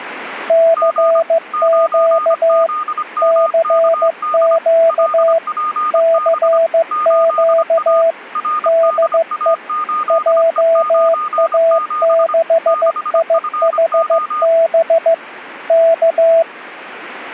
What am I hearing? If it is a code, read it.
Morse code, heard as two keyed tones. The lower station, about 15 wpm, 660 Hz: CQ CQ CQ DE JA6IHB K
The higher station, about 25 wpm, 1220 Hz: G 9ZMKD LPB 8A RDA8E97 6FO